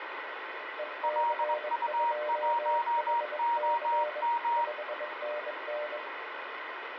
Morse code, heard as two keyed tones, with radio static and room echo. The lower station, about 22 wpm, 600 Hz: EC2HC 5NN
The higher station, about 21 wpm, 940 Hz: LU1OM